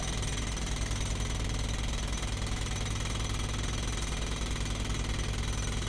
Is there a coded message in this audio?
No, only street noise.